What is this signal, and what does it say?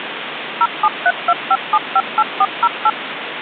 DTMF, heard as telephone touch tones, dialled by machine, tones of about 50 ms, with phone line noise. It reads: 07325758408